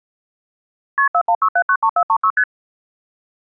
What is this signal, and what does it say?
Multi-frequency trunk signalling (R1, as on North American trunks), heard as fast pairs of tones, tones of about 70 ms. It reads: KP 416793436 ST